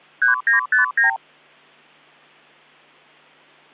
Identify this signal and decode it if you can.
Multi-frequency trunk signalling (R2, with the far end's replies), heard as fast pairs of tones, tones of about 130 ms. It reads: 3959